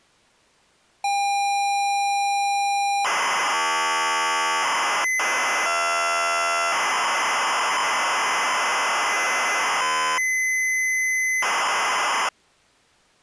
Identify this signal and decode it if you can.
ZX Spectrum tape loading, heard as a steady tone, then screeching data.